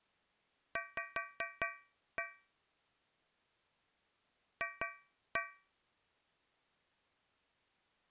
Tap code, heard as taps on a metal pipe, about 4 knocks a second. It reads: V F